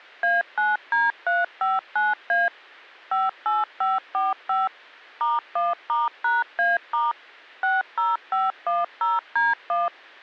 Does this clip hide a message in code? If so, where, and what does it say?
Yes: DTMF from 0.2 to 9.9 s, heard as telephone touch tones, dialled by machine, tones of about 180 ms. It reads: A9D359A 58545 *1*#A* 60510D1